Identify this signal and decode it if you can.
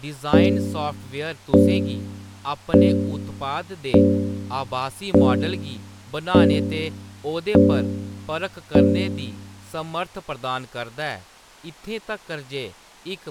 Clock strike, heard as a bell, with speech in Dogri. 8. Eight o'clock.